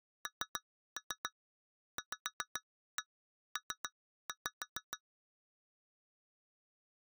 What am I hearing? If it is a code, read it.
Tap code, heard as taps on glass, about 7 knocks a second. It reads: NVP